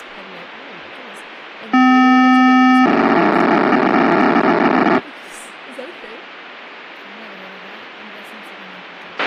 POCSAG pager data (512 baud), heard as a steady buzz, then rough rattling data, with a squelch burst at the end and speech in English.